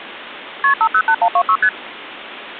Multi-frequency trunk signalling (R1, as on North American trunks), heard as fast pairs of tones, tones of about 70 ms. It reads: KP 508126 ST